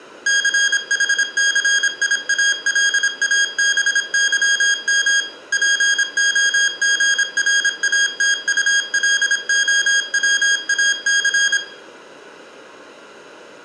Morse code, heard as electronic beeps, machine-sent, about 26 wpm, 1650 Hz, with room echo. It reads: CHCIALABYM POGRATULOWAC